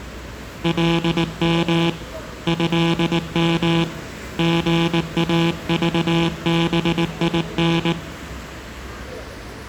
Morse code (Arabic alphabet), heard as a buzzer, hand-sent with a paddle, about 19 wpm, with street noise. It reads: لم هم غاضبين